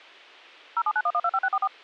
DTMF, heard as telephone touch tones, dialled by machine, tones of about 50 ms. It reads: 0791125644